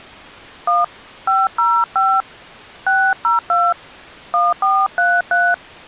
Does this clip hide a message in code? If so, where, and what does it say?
Yes: DTMF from 0.7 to 5.5 s, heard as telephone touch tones, dialled by hand, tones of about 200 ms. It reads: 1 505 602 1433